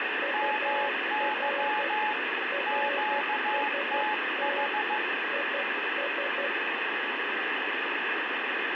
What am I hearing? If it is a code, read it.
Morse code, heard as two keyed tones, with radio static. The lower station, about 12 wpm, 560 Hz: UR RST IS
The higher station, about 15 wpm, 850 Hz: MY QTH